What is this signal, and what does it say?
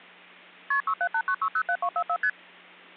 Multi-frequency trunk signalling (R1, as on North American trunks), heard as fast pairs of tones, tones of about 70 ms, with hum. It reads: KP 6789607244 ST